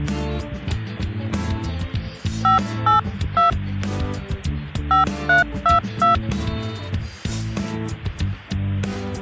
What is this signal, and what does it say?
DTMF, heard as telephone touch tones, dialled by hand, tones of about 130 ms. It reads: 582 5322